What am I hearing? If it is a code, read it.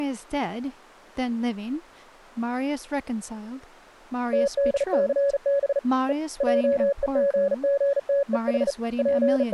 Morse code (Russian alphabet), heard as a keyed tone, hand-sent with a bug key, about 37 wpm, 560 Hz, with speech in English. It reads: ТДЦБ Е ЙЕГГТЕХ …